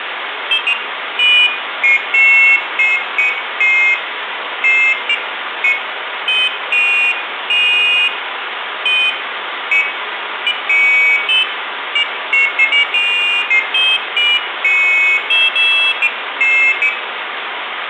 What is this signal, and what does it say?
Pairs of high tones at irregular times, with phone line noise and room echo. There is no code.